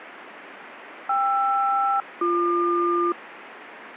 Aircraft SELCAL, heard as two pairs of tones, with radio static. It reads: KR-BQ